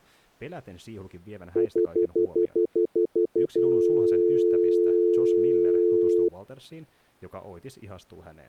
Telephone call progress tone (North American plan), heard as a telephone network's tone, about 350, 440 Hz, 0.1 s on and 0.1 s off, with speech in Finnish. Stutter dial tone.